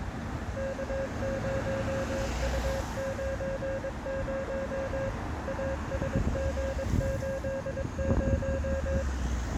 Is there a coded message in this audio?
Yes: Morse code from 0.5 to 9.1 s, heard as a keyed tone, machine-sent, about 22 wpm, 540 Hz, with street noise. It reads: K0U90 ASG80